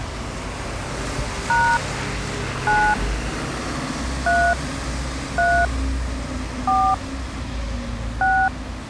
DTMF, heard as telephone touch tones, dialled by hand, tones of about 270 ms, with street noise. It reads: # 9 3 3 4 6